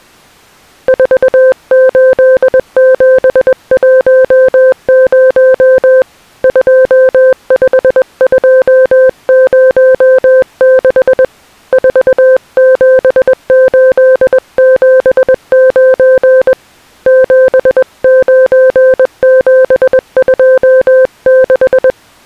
Morse code, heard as a keyed tone, hand-sent with a paddle, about 21 wpm, 520 Hz. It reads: 48710 25206 47879 79726